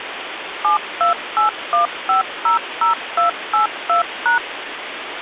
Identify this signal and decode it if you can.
DTMF, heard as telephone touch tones, dialled by machine, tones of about 120 ms, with phone line noise. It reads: 7281500282#